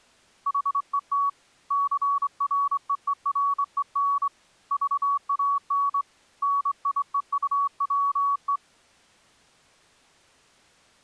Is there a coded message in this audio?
Yes: Morse code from 0.4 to 8.6 s, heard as a keyed tone, hand-sent with a straight key, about 24 wpm, 1130 Hz. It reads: HET CREEREN VAN NIEUWE